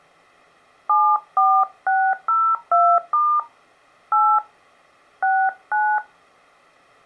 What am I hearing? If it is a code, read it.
DTMF, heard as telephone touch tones, dialled by hand, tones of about 270 ms. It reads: 74602* 8 69